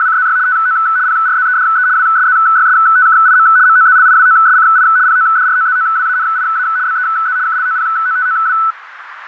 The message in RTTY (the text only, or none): … TO PRZEDE WSZYSTKIM MOZLIWOSCI PODROZOWANIA BEZ KLOPOTOW